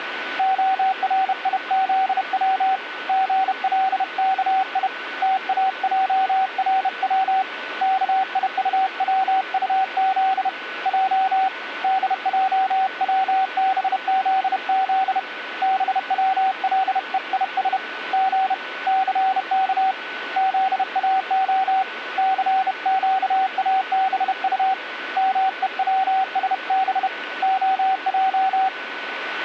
Morse code (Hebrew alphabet), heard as a keyed tone, hand-sent with a bug key, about 31 wpm, 760 Hz, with radio static and a steady whistle near 1490 Hz. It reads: הריזץ גלכי תאערץ כיטצטז ע דעצבזז בצלויש ג סך זאה סקאבט מוצשב הע